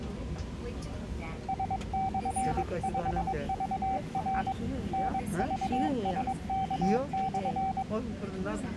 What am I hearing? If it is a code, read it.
Morse code, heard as a keyed tone, hand-sent with a paddle, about 22 wpm, 770 Hz, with the noise inside a subway train. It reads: S/5VR NVSK/